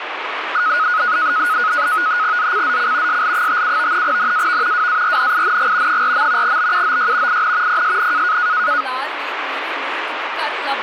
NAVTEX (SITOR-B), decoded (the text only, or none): ZCZC SL57 NAV WARNING 4. BUOY IN PSN